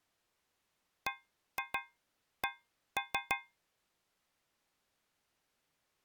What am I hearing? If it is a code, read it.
Tap code, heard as taps on a metal pipe, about 6 knocks a second. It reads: BC